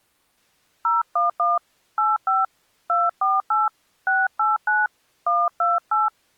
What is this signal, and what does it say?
DTMF, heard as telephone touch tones, dialled by hand, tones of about 180 ms. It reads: 011 85 248 689 128